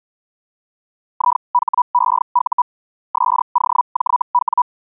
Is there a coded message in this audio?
Yes: Hellschreiber (Feld-Hell, 122.5 baud) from 1.1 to 4.6 s, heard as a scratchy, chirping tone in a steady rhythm, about 980 Hz. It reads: IHEU SOJW